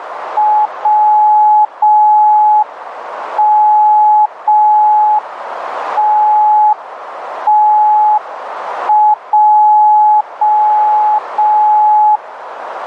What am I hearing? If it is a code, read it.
Morse code, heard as a keyed tone, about 5 wpm, 850 Hz, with radio static and a narrow filter. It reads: WMTTJ